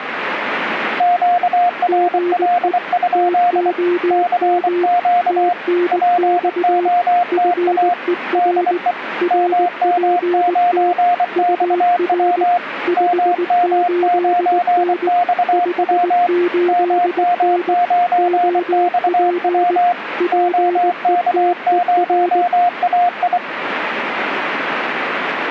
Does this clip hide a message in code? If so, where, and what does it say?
Yes: Morse code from 0.9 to 23.4 s, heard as two keyed tones, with radio static. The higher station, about 24 wpm, 710 Hz: QRL? CQ POTA DE MM9XW MM9XW MM9XW OK0AI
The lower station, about 19 wpm, 350 Hz: GE TOM TNX FER RPT UR 58N 58N OP PETER